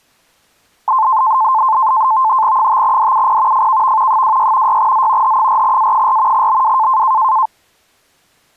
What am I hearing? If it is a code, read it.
NAVTEX (SITOR-B), 100 baud, 170 Hz shift, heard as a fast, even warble, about 960 Hz centre. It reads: 5DUP FKV 26 6Z H4A4 BW